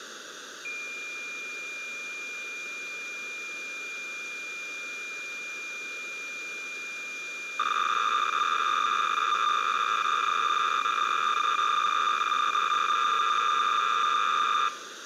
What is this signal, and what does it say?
Cassette data (Kansas City type), 300 baud, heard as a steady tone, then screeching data, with tape hiss.